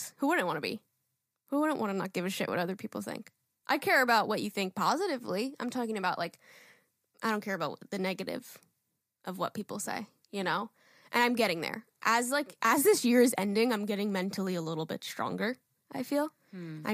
Speech in English. There is no code.